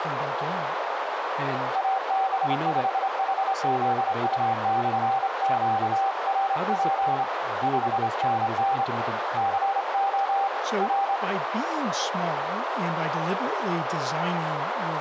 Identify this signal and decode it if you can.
Morse code, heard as a keyed tone, hand-sent with a straight key, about 27 wpm, 780 Hz, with radio static, a narrow filter and speech in English. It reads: AB5HZU/QRP 5NN CO R